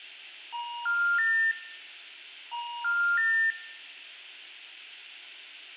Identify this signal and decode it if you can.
Telephone call progress tone (ITU plan), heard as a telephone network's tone, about 950, 1400, 1800 Hz, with room echo. Special information tone.